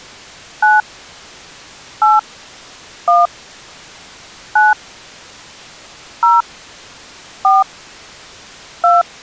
DTMF, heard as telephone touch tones, dialled by hand, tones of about 180 ms. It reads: 9 8 1 9 0 4 2